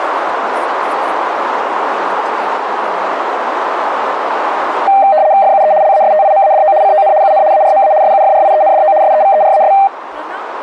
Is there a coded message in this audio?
Yes: RTTY (75 baud, 170 Hz shift) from 4.9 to 9.9 s, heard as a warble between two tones, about 700 Hz centre, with radio static and speech in Maithili. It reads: FUE LASTIMADO CON UN ARMA SUFRIENDO SEVERAS